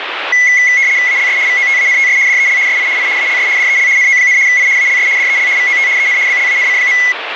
RTTY (75 baud, 170 Hz shift), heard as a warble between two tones, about 2050 Hz centre, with radio static. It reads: ALS VOTANTS DEL SI I ALS DEL NO, I ALS DEL VOT EN BLANC.